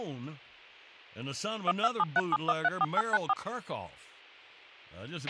DTMF, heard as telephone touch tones, dialled by machine, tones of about 40 ms, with a squelch burst at the end and speech in English. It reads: 12737134894